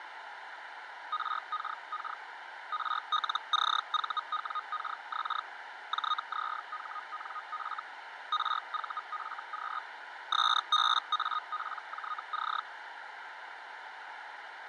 Hellschreiber (Feld-Hell, 122.5 baud), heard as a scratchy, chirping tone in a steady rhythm, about 1240 Hz, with radio static, fading and a narrow filter. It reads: RKK RLCVWKX JZHNF RVFQ SBAPJC